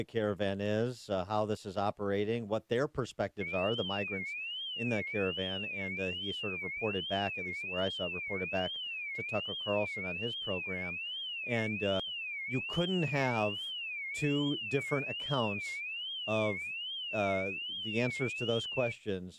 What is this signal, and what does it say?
A tone that sweeps in pitch again and again, with speech in English. There is no code.